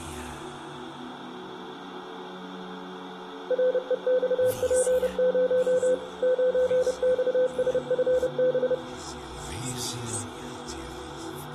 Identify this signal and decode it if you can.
Morse code, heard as a keyed tone, machine-sent, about 30 wpm, 510 Hz, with room echo. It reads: REXP0 9XSFB